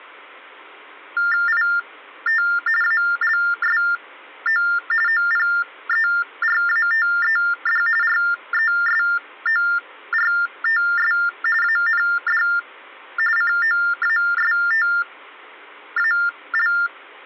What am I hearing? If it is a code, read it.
TTY/TDD text telephone tones (45.45 baud Baudot), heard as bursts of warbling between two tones, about 400 Hz shift, 1600 Hz centre. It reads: IT ALSO OPERATED RESORTS AND COASTAL